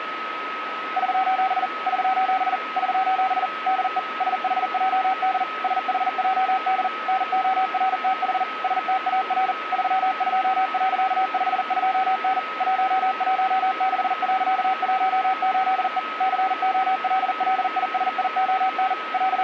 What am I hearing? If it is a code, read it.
Morse code, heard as a keyed tone, machine-sent, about 40 wpm, 760 Hz, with radio static and a steady whistle near 1280 Hz. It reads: <SOS> <SOS> <SOS> DE SHJD SHJD NORTH STAR 32.52N 116.18E COLLISION …